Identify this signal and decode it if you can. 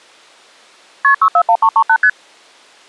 Multi-frequency trunk signalling (R1, as on North American trunks), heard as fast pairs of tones, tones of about 70 ms. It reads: KP 641338 ST